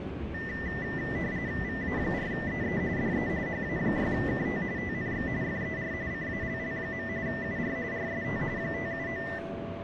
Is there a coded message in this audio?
Yes: RTTY (45.45 baud, 170 Hz shift) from 0.3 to 9.4 s, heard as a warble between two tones, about 1900 Hz centre, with radio static and the noise inside a subway train. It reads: VA4EE DE HA6KT TNX FER CALL. UR RST 579